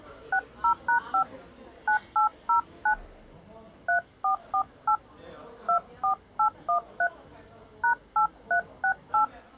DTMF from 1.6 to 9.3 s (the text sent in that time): 9809 3448 24813 #8368